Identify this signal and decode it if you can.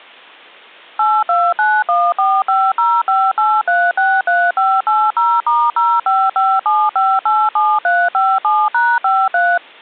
DTMF, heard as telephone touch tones, dialled by machine, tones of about 240 ms. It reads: 829145058363580*0557587357#53